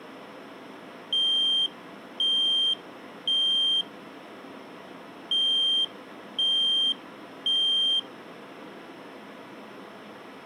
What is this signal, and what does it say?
Alarm pattern, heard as an alarm's beeps, played twice, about 3150 Hz. Temporal three. Smoke or fire, evacuate.